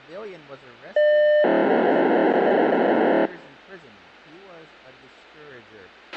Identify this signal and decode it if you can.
POCSAG pager data (1200 baud), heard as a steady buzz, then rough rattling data, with a squelch burst at the end.